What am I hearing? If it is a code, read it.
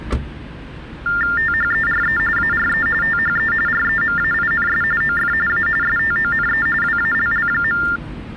TTY/TDD text telephone tones (45.45 baud Baudot), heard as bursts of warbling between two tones, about 400 Hz shift, 1600 Hz centre, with street noise. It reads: THERE ARE THE REMAINS OF A STONE WALL.